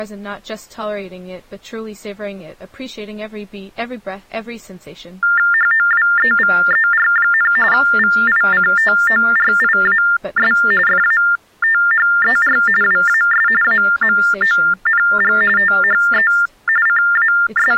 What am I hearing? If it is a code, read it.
TTY/TDD text telephone tones (45.45 baud Baudot), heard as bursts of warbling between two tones, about 400 Hz shift, 1600 Hz centre. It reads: HOWEVER, VICTORIAS FATHER WAS AMONG THE …